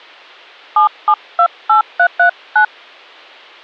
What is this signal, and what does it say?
DTMF, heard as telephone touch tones, dialled by hand, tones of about 90 ms. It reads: 7728339